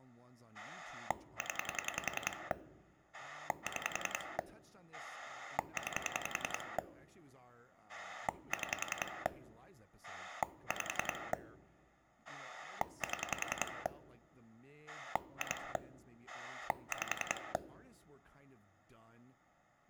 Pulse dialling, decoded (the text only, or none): 0 6 9 6 5 7 2 5